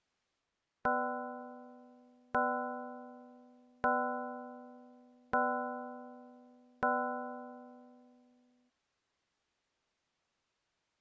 Clock strike, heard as a bell. 5. Five o'clock.